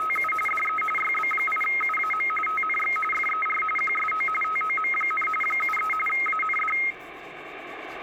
RTTY (45.45 baud, 850 Hz shift), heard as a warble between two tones, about 1700 Hz centre, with radio static and the noise of a restroom. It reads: … DE YB8UAM TNX FER QSO TOM, 73 AND